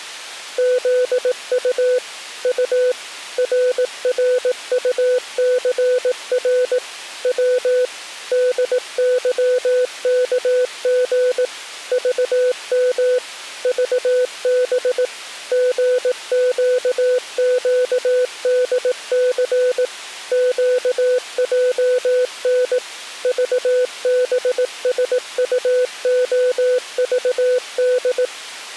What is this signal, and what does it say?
Morse code, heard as a keyed tone, machine-sent, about 18 wpm, 500 Hz. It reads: ZU U RRUCR W DYKG VM VB GQQDC QJN VBSUOVD